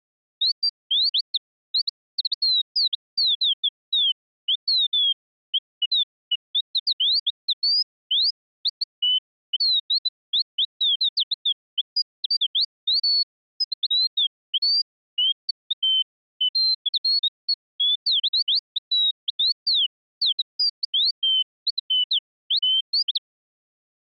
Bird-like chirps. There is no code.